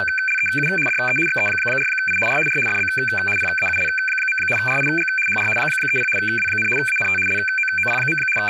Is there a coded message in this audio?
Yes: RTTY (75 baud, 850 Hz shift) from 0.0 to 8.5 s, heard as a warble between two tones, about 1950 Hz centre, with room echo and speech in Urdu. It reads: … DE XE4I R R FB PAUL. RIG HR 30 W, ANT LOOP. …